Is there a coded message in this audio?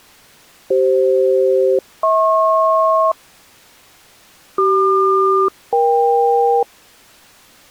Yes: aircraft SELCAL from 0.7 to 6.6 s, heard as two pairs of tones. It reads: CF-HP CQ-EK